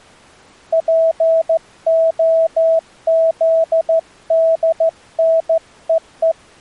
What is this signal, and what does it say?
Morse code (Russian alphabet), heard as a keyed tone, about 14 wpm, 650 Hz. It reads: ПОЗДНЕЕ